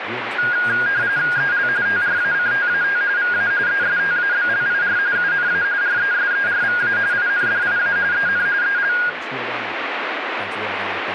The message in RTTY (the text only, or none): EL TRACTAT VA ESTABLIR UNA RESERVA INDIA EN EL